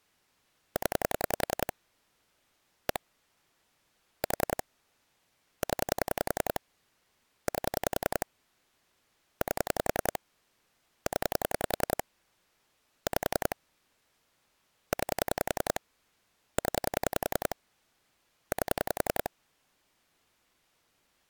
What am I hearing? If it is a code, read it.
Pulse dialling, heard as clicks on a phone line, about 10 pulses a second. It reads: 0 1 4 0 8 8 0 5 9 0 8